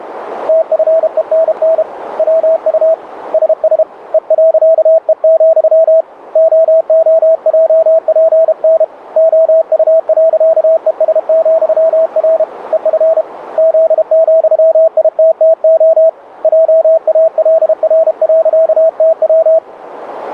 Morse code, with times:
0.5-1.8 TFENN
2.2-2.9 WU
3.3-3.8 SS
4.1-6.0 E.E,
6.4-8.8 OOJPN
9.2-12.4 OU.ES,R
12.7-13.2 EF
13.6-16.1 Z,ITTO
16.4-19.6 JALR.TW

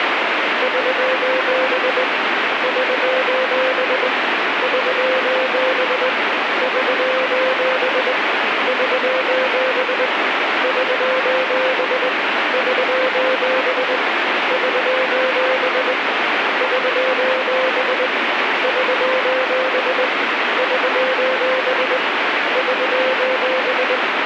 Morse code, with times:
0.6-2.0 <SOS>
2.6-4.1 <SOS>
4.6-6.1 <SOS>
6.6-8.1 <SOS>
8.7-10.1 <SOS>
10.6-12.1 <SOS>
12.5-14.0 <SOS>
14.5-15.9 <SOS>
16.6-18.1 <SOS>
18.6-20.1 <SOS>
20.6-22.0 <SOS>
22.6-24.0 <SOS>

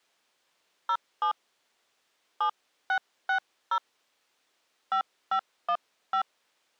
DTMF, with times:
0.9-1.3 07
2.4-3.8 7660
4.9-6.2 5515

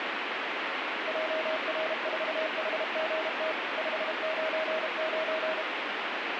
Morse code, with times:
1.1-3.5 JR4HGT
3.8-5.6 599

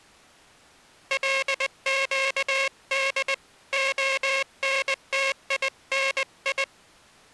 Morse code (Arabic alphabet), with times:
1.1-3.3 لقد
3.7-6.6 خنتيني

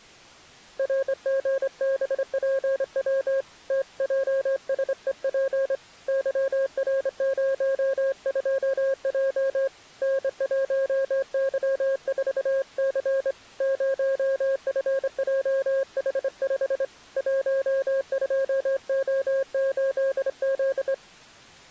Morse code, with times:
0.8-3.4 RGBPW
3.7-5.8 TJSEP
6.1-9.7 YR02J
10.0-13.3 N1Y4C
13.6-16.8 0FJH5
17.2-20.9 12O8Z

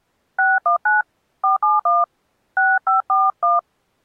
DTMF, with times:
0.4-1.0 619
1.4-2.0 471
2.6-3.6 6541

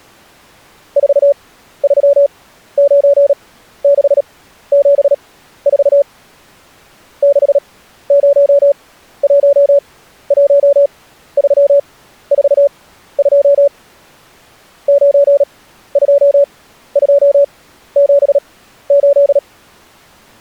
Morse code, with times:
1.0-6.0 439674
7.2-13.7 6011342
14.9-19.4 92278

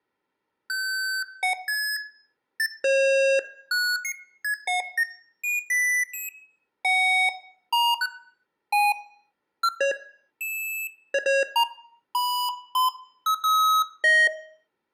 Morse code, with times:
none

